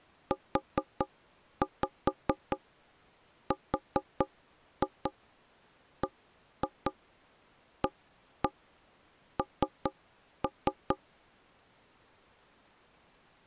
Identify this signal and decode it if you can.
Tap code, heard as knocks on wood, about 4 knocks a second. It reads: URBAN